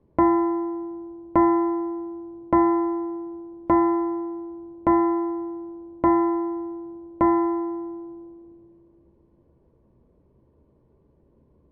Clock strike, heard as a bell, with room echo. 7. Seven o'clock.